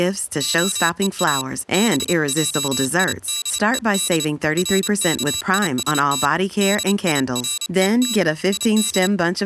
Morse code (Hebrew alphabet), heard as a high beeper, hand-sent with a paddle, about 29 wpm, 3900 Hz, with speech in English. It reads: הוא בעידוד רכישת דירות יד